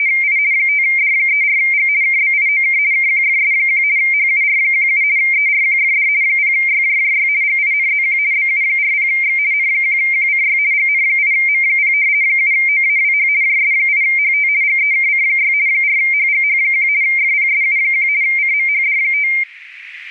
RTTY (50 baud, 170 Hz shift), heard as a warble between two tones, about 2200 Hz centre, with static crashes. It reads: … 5D34G KBIOK KQFS1 HUR17 ERQFD 0YJJY GINZQ BU40X N1QCY GN8M0 7OAWH JS8HT GEKC6 4HGH1 FPSU1 CMHD5